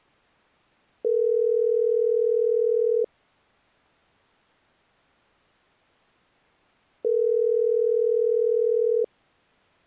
Telephone call progress tone (North American plan), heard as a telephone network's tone, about 440, 480 Hz, 2 s on and 4 s off. Ringback tone.